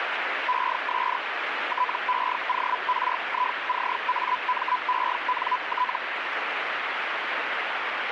Hellschreiber (Feld-Hell, 122.5 baud), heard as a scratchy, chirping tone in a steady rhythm, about 1000 Hz, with radio static. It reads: ES TEORICAMENT